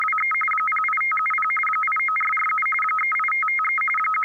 RTTY (45.45 baud, 850 Hz shift), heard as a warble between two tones, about 1700 Hz centre. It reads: … 08570 89447 38553 …